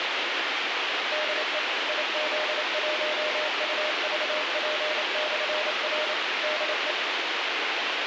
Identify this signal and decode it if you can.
Morse code, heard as a keyed tone, machine-sent, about 28 wpm, 610 Hz, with radio hiss. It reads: DE IZ1UVP/R DE